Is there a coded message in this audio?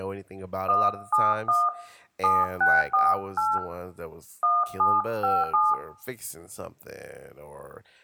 Yes: DTMF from 0.7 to 5.7 s, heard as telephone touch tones, dialled by hand, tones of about 210 ms, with room echo and speech in English. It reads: 171 7648 1757